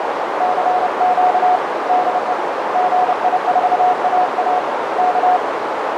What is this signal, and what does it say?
Morse code, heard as a keyed tone, hand-sent with a paddle, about 30 wpm, 730 Hz, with heavy radio static and a narrow filter. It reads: CQ DE GI4AA K